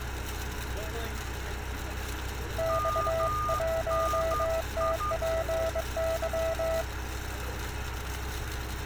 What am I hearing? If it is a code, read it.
Morse code, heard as two keyed tones, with radio static and street noise. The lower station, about 22 wpm, 650 Hz: X1TPY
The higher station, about 12 wpm, 1220 Hz: MNI